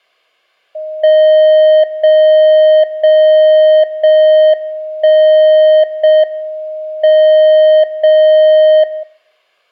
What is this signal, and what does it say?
Radio time signal (JJY), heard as a tone whose level steps once a second, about 620 Hz. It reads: 0 0 0 1 0 M 0 0